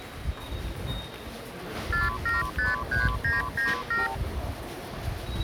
Multi-frequency trunk signalling (R2, with the far end's replies), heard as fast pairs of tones, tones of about 160 ms, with the noise of a subway station. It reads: 4753997